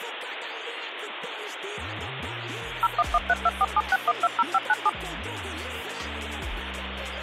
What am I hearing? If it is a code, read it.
DTMF, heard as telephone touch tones, dialled by machine, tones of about 40 ms, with phone line noise. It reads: 01132476120597